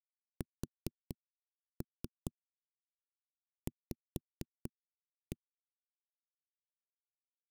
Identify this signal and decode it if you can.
Tap code, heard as knocks on a wall, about 4 knocks a second. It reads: SV